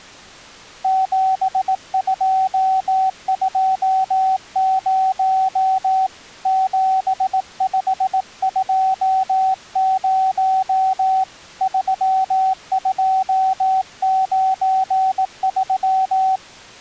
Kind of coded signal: Morse code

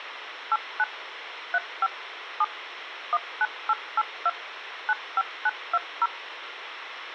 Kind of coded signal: DTMF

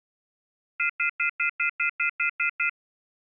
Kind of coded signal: telephone call progress tone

